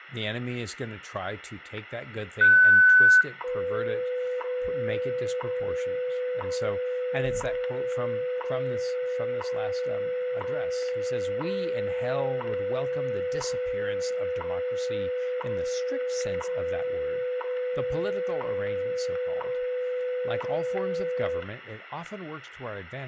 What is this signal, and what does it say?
Radio time signal (WWV, Colorado), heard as ticks, one a second, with static crashes, room echo and speech in English.